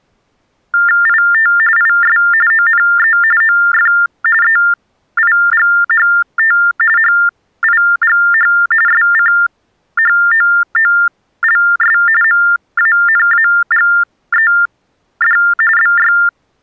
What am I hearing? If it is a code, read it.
TTY/TDD text telephone tones (45.45 baud Baudot), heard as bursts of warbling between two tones, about 400 Hz shift, 1600 Hz centre. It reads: IT IS ONE OF EIGHT HIGH SCHOOLS MANAGED BY